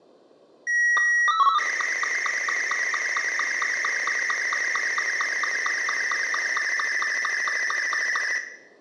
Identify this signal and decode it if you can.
SSTV (slow-scan television), Martin M2, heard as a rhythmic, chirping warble, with room echo.